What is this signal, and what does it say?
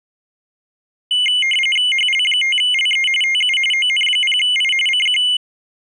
RTTY (45.45 baud, 850 Hz shift), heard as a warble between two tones, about 2550 Hz centre. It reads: HL5LE TU ON0I CQ